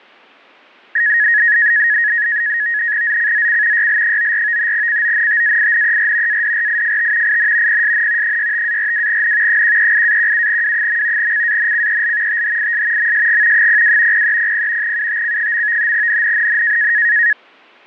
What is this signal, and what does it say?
NAVTEX (SITOR-B), 100 baud, 170 Hz shift, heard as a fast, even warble, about 1800 Hz centre. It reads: ZCZC YL94 CONTAINER ADRIFT IN PSN 65-42N 138-17W. CANCEL THIS MSG 02 0300 UTC. NNNN